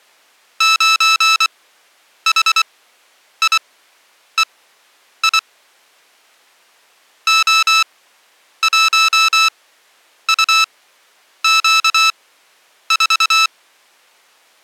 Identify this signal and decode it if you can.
Morse code, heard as electronic beeps, machine-sent, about 24 wpm, spaced as for 9 wpm, 1310 Hz. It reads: 9HIEI O1UQ4